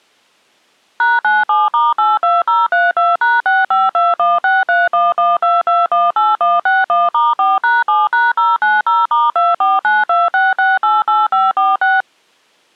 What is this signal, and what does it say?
DTMF, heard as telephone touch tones, dialled by machine, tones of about 190 ms. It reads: #97*82032#652163112218161*4#7#090*24926688546